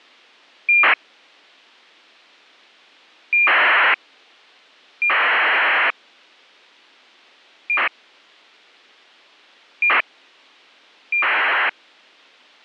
ACARS aircraft data, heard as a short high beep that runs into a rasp, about 2400 baud.